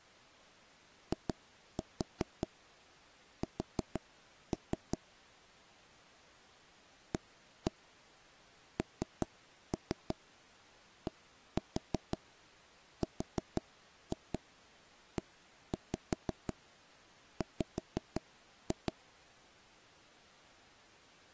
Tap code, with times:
1.1-5.0 IS
7.1-18.9 ANDREW

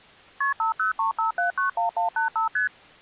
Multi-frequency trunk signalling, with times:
0.4-0.5 KP
0.6-2.5 5035791185
2.6-2.7 ST

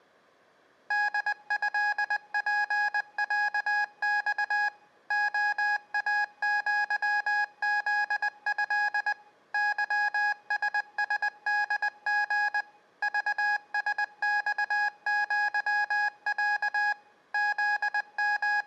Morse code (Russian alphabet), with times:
0.9-4.7 ДЭПЯЬ
5.1-9.1 ОАЪЗЭ
9.5-12.6 ЫССДГ
13.0-16.9 ЖСЬЪЯ
17.3-18.7 …

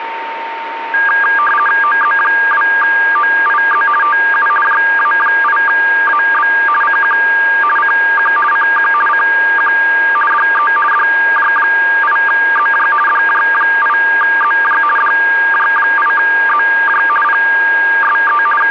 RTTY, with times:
1.8-3.9 OZ2OIZ
4.0-4.5 TU
4.6-6.5 JA8AB
6.8-7.2 CQ
7.8-8.3 CQ
8.5-8.9 CQ
9.1-9.7 CQ
10.3-10.7 DE
10.9-12.9 DJ8ZJ
13.1-14.8 DJ8ZJ
15.0-17.0 DJ8ZJ
17.2-18.4 PSE
18.6-18.7 …

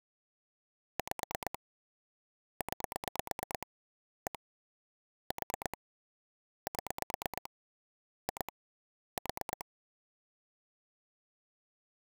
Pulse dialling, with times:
1.0-1.6 5
2.6-3.7 9
4.3-4.4 1
5.3-5.8 4
6.7-7.5 7
8.3-8.5 2
9.2-9.6 4

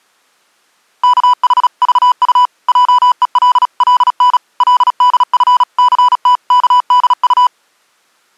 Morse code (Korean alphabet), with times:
1.0-2.5 우리
2.7-4.4 학교
4.6-7.5 근처의

